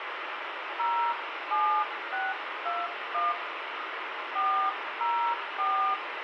DTMF, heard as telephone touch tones, dialled by hand, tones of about 280 ms, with radio hiss and room echo. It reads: 07621 404